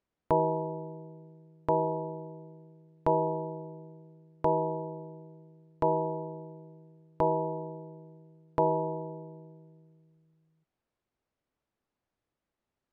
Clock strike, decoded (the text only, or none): 7